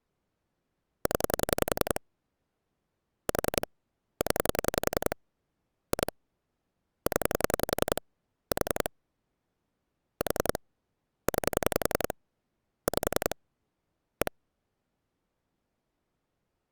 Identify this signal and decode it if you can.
Pulse dialling, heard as clicks on a phone line, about 10 pulses a second. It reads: 0 4 0 2 0 4 4 9 5 1